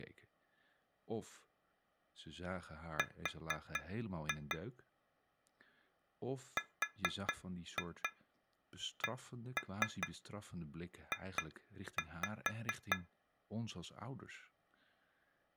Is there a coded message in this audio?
Yes: tap code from 3.0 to 13.1 s, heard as taps on glass, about 4 knocks a second, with speech in Dutch. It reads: R RCJ